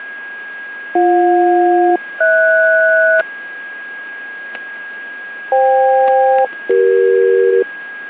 Aircraft SELCAL, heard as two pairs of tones, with static crashes and a steady whistle near 1640 Hz. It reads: BJ-HS FK-CE